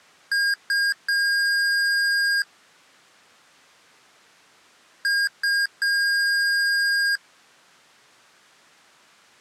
Beep code, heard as beeps from a small speaker, played twice, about 1600 Hz. 2 short, 1 long.